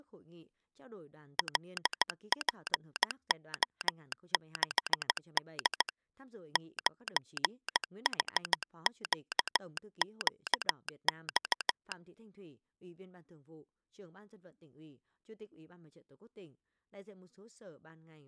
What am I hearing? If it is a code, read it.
Morse code, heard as a telegraph sounder, hand-sent with a straight key, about 15 wpm, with speech in Vietnamese. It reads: LPO6D 9HQQX